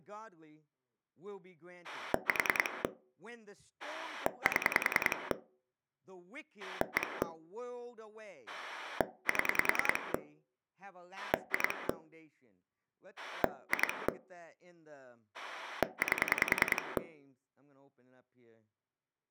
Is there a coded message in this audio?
Yes: pulse dialling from 1.8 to 17.0 s, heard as a rotary dial, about 10 pulses a second, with speech in English. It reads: 4 7 1 7 2 2 8